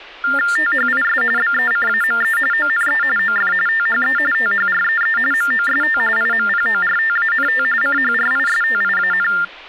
TTY/TDD text telephone tones (45.45 baud Baudot), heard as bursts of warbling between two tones, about 400 Hz shift, 1600 Hz centre, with speech in Marathi. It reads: THIS BECAME ONE OF THE THREE MOST IMPORTANT CHRISTIAN